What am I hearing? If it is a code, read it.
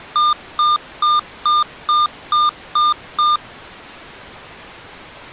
Beep code, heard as beeps from a small speaker, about 1210 Hz. 8 short. In AMI BIOS tables: display memory failure; in Dell tables: LCD failure.